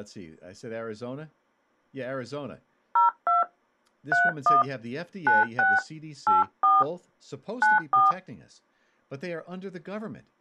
DTMF, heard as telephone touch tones, dialled by hand, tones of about 160 ms, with speech in English. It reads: 02 31 96 84 94